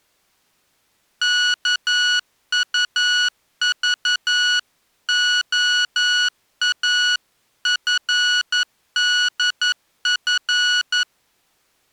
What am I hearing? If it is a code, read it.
Morse code (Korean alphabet), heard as electronic beeps, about 11 wpm, 1460 Hz. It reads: 일포는